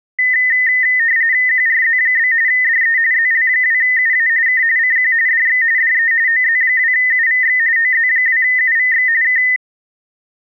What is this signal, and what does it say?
RTTY (45.45 baud, 170 Hz shift), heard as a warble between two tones, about 1900 Hz centre. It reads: QRZ? DE ZL2UA K CQ DX DE OZ2UVX OZ2UVX K